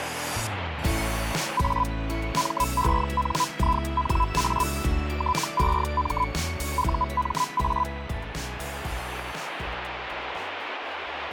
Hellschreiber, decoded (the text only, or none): A MENINA TEM UMA